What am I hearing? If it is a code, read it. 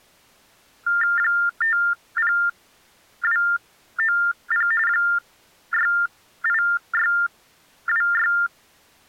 TTY/TDD text telephone tones (45.45 baud Baudot), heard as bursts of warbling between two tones, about 400 Hz shift, 1600 Hz centre. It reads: 50290 68626